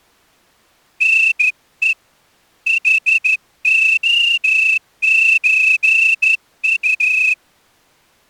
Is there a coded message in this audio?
Yes: Morse code (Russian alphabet) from 0.9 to 7.4 s, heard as a whistle, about 13 wpm. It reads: НЕ ХОЧУ